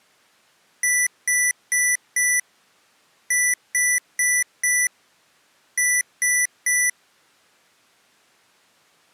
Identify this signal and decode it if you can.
Beep code, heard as beeps from a small speaker, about 2000 Hz. 4-4-3. In Phoenix BIOS tables: maths coprocessor failure.